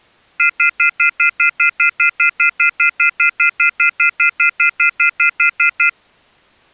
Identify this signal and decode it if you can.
Telephone call progress tone (North American plan), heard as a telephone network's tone, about 1400, 2050, 2450, 2600 Hz, 0.1 s on and 0.1 s off. Off-hook warning tone.